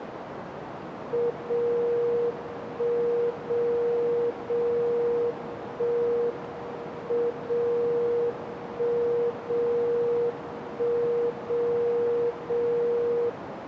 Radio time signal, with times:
1.3-2.3 0
2.3-3.3 1
3.3-4.3 0
4.3-5.3 0
5.3-6.3 1
6.3-7.3 M
7.3-8.3 0
8.3-9.3 1
9.3-10.3 0
10.3-11.3 1
11.3-12.3 0
12.3-13.3 0

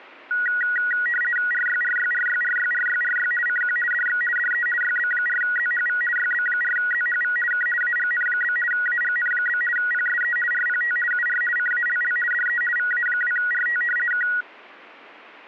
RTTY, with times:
1.5-3.3 RYRYRYRYRYRY
3.5-3.8 CQ
3.9-4.2 DX
4.4-4.7 DE
4.8-6.0 YB4ZHV
6.2-7.4 YB4ZHV
7.5-7.7 K
7.8-8.6 AGN?
8.7-9.6 AGN?
9.8-10.4 PSE
10.5-11.0 RPT
11.1-11.4 UR
11.6-12.2 CALL
12.3-12.6 DE
12.8-13.8 VA2RT
14.1-14.3 K

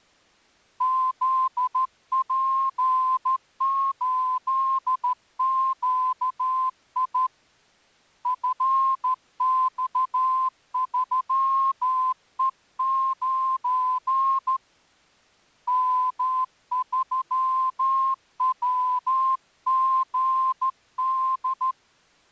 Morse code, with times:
0.8-7.3 ZP8QI
8.3-14.6 FX3E9
15.7-21.7 M3WGD

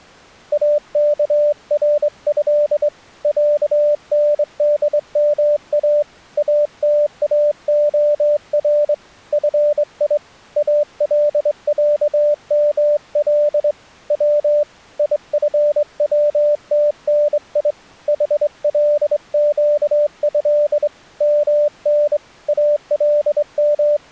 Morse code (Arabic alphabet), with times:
0.5-2.9 اكره
3.2-6.0 عندما
6.4-8.9 اتاخر
9.3-10.2 في
10.6-13.7 العمل
14.1-14.6 و
15.0-17.7 يفوتني
18.1-20.9 حلقه
21.2-22.2 من
22.5-24.1 …

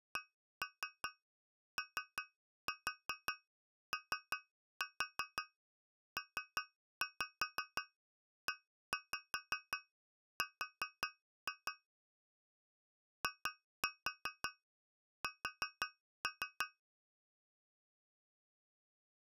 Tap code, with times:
0.2-11.7 COOPER
13.2-16.7 IS

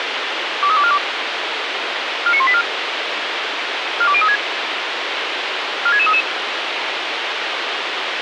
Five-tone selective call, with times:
0.6-1.0 23242
2.3-2.6 49184
4.0-4.4 42036
5.9-6.2 46633

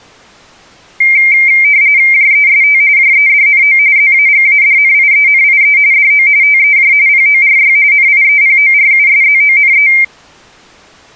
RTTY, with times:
2.1-2.8 JEST
3.0-3.8 JEDNO
4.0-5.8 ZAGADNIENIE
5.9-6.3 DO
6.4-6.9 TEJ
7.1-7.8 PORY
7.9-9.9 NIEPORUSZONE

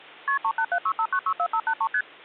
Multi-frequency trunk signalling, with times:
0.3-0.4 KP
0.4-1.9 38765964583
1.9-2.0 ST

